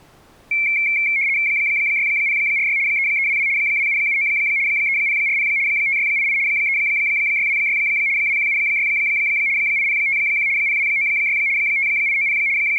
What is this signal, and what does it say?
RTTY (75 baud, 170 Hz shift), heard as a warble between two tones, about 2250 Hz centre. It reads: 6046 3322 2779 3040 5688 3626 2176 8051 0296 5890 …